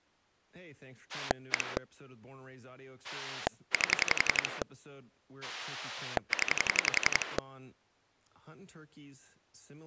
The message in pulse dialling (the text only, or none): 1 8 0